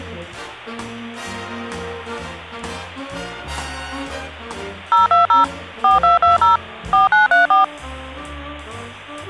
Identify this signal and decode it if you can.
DTMF, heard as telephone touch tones, dialled by machine, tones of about 140 ms, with hum. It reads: 020 4220 4934